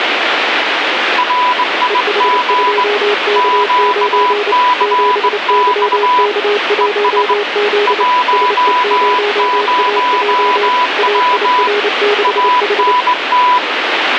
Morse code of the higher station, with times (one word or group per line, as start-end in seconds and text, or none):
1.2-2.8 RIG
3.4-6.3 QCX
6.8-7.3 ES
7.9-11.7 10W
12.2-13.6 ANT